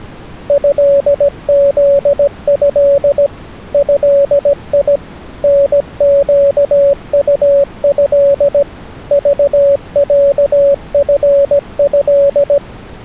Morse code (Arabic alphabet), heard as a keyed tone, machine-sent, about 17 wpm, 560 Hz. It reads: هذه هي نقطه ضعفه